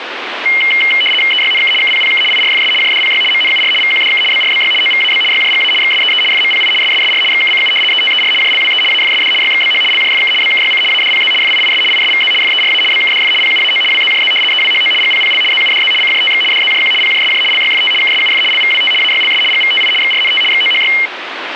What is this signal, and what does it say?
RTTY (75 baud, 850 Hz shift), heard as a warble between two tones, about 2550 Hz centre, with radio static. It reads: EYNK KPPK IRFS JDPY MNUR VQDK BRBY OVAB YJGA XSEE FMPI SSSR XKCU ETER JLWE AFSD YXBH LJFK BKYC ADPZ FIIS ISVZ FERA BKDF PUAO WZJZ EWHO GPPL ZUDZ CJTX DZJQ PJSJ LYFT KSUF LVWT AYLS GVTI XRNT XOHY